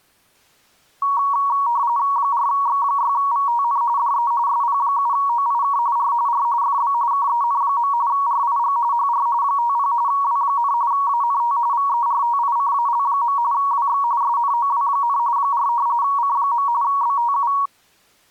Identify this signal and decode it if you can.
RTTY (45.45 baud, 170 Hz shift), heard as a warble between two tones, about 1030 Hz centre. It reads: 4X6VTN DE SP7OIK R R FB KEN. RIG HR 50 W, ANT VERTICAL. WX SNOW, 4 C. BTU